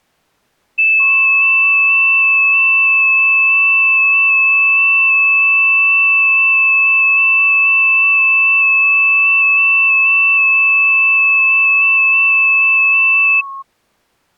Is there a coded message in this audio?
Yes: FT8 (several signals at once) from 0.8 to 13.6 s, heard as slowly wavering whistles, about 6.25 baud.